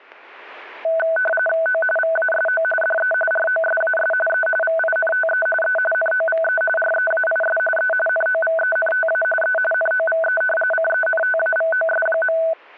RTTY (45.45 baud, 850 Hz shift), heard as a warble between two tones, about 1080 Hz centre, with static crashes. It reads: O VASO DE ROSAS E VINTE E NOVE REAIS E NOVENTA E NOVE CENTAVOS.